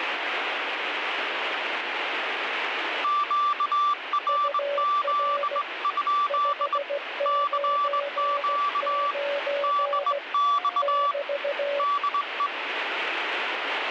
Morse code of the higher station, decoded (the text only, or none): QRZ? CQ DX DE